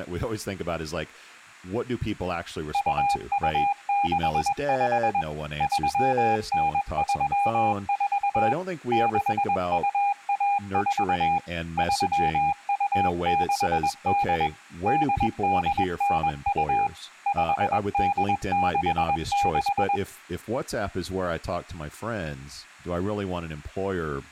Morse code (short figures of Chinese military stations), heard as a keyed tone, machine-sent, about 21 wpm, 810 Hz, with speech in English. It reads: 2265 3934 6214 3268 8892 5866